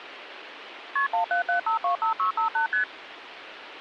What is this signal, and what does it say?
Multi-frequency trunk signalling (R1, as on North American trunks), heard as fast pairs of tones, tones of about 110 ms, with phone line noise. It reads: KP 177525658 ST